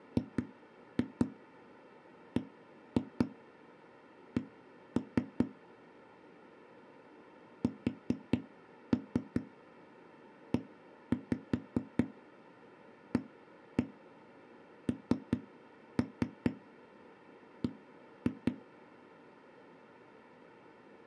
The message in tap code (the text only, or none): GBC SEANB